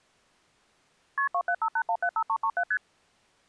Multi-frequency trunk signalling (R1, as on North American trunks), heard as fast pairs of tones, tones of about 70 ms. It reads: KP 2758175337 ST